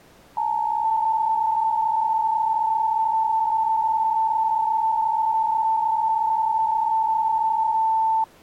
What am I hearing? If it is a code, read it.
PSK63 (62.5 baud), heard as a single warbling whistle, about 890 Hz.